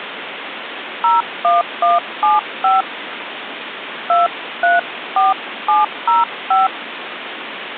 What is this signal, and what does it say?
DTMF, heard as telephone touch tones, dialled by hand, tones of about 170 ms, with phone line noise. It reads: 01175 234705